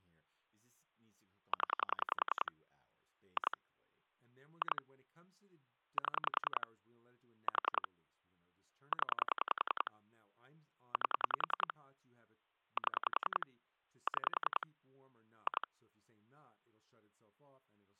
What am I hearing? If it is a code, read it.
Pulse dialling, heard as clicks on a phone line, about 10 pulses a second, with speech in English. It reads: 0 2 2 7 4 0 8 7 6 2